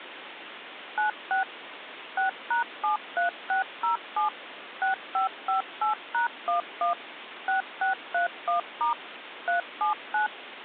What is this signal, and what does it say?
DTMF, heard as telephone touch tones, dialled by machine, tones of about 120 ms, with phone line noise. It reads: 96 6#73607 6558#11 6631* 379